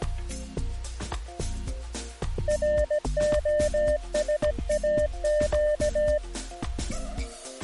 Morse code, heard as a keyed tone, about 17 wpm, 600 Hz. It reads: ROSAQ